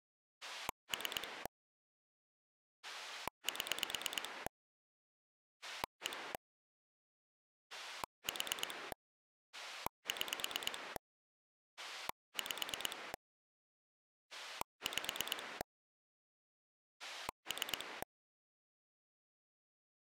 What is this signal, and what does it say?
Pulse dialling, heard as a rotary dial, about 9 pulses a second. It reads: 3 7 1 4 6 5 5 3